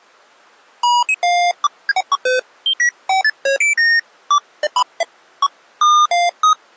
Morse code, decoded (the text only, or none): none